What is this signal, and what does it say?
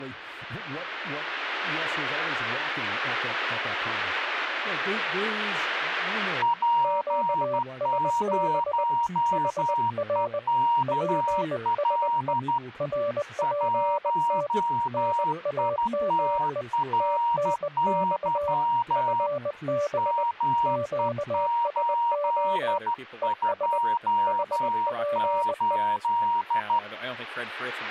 Morse code, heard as two keyed tones, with speech in English. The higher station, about 13 wpm, 940 Hz: P0EKL 1ITRY ME828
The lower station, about 20 wpm, 580 Hz: QSB HR PSE RPT NAME TNX FB QSO ES HPE